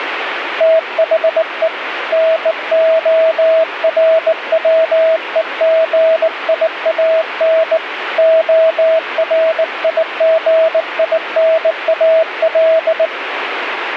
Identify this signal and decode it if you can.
Morse code, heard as a keyed tone, hand-sent with a bug key, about 19 wpm, 650 Hz, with radio static. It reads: THE NORWEGIAN ORIGINAL